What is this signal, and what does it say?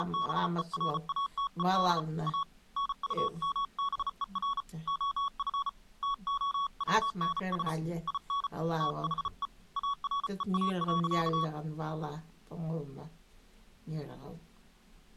Morse code, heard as a keyed tone, hand-sent with a bug key, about 34 wpm, 1120 Hz. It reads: … A NUMBER OF TOWNS IN THE AREA.